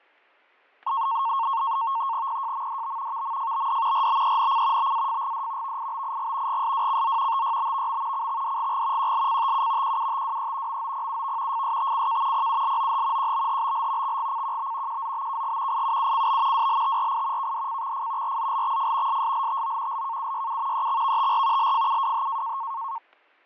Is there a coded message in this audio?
Yes: NAVTEX (SITOR-B), 100 baud, 170 Hz shift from 0.9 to 23.0 s, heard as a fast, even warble, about 1000 Hz centre, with fading and static crashes. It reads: PJMDB VMFBD RBENC BAFGD VIBIG GSWCZ TYBVM CXDGG QLCTU QUTWE MOPUV FSTCK PULOH QBHBL XGCQB QZBKG IUUCB WLTRI KDCXF RZLXF SSLTO LKUYU EXVTR LFUWH